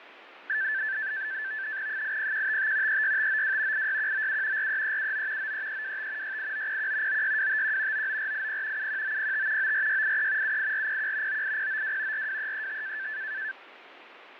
NAVTEX (SITOR-B), 100 baud, 170 Hz shift, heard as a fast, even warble, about 1650 Hz centre, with radio static and fading. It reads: 80155 36592 86197 43379 93325 68901 96251 99480 71905 94683 78401 98092 42335